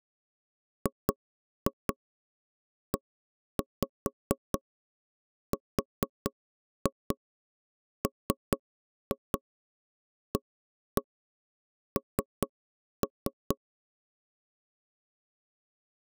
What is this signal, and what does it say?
Tap code, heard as knocks on wood, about 4 knocks a second. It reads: GERMAN